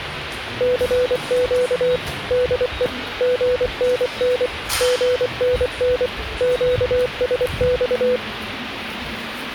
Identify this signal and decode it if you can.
Morse code, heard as a keyed tone, machine-sent, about 24 wpm, 500 Hz, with radio hiss and the noise of a subway station. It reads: CQ DE GNN GNN QSX